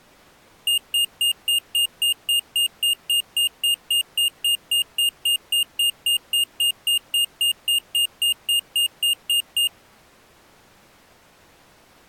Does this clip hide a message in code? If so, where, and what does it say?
No, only evenly repeated beeps.